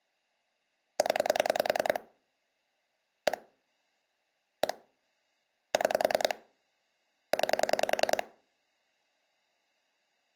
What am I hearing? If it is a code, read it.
Pulse dialling, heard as clicks on a phone line, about 10 pulses a second. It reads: 0 1 1 6 9